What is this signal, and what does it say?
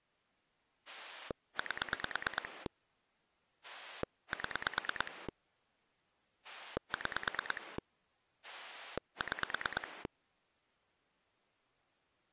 Pulse dialling, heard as a rotary dial, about 9 pulses a second. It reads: 8 7 6 6